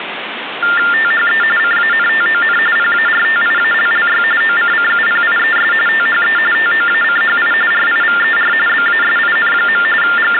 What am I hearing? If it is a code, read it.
TTY/TDD text telephone tones (45.45 baud Baudot), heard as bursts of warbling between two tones, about 400 Hz shift, 1600 Hz centre, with phone line noise. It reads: THE CANTON PARTIALLY OCCUPIES THE TOACHI RIVER BASIN. …